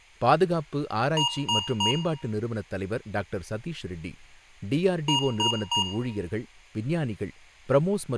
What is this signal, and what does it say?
Beep code, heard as beeps from a small speaker, played twice, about 950 Hz, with room echo and speech in Tamil. 3 short. In AMI BIOS tables: failure in the first 64 KB of memory; in Dell tables: chipset error.